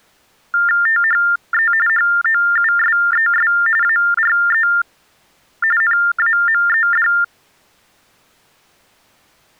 TTY/TDD text telephone tones (45.45 baud Baudot), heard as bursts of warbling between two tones, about 400 Hz shift, 1600 Hz centre. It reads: THE HOUSES ARE NAMED